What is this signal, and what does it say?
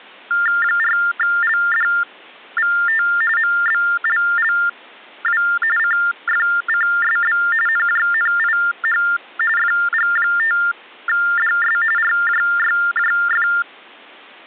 TTY/TDD text telephone tones (45.45 baud Baudot), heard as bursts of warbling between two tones, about 400 Hz shift, 1600 Hz centre. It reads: 4LDVT MBLLW CFCSB NJNIH FG5DS RJYJF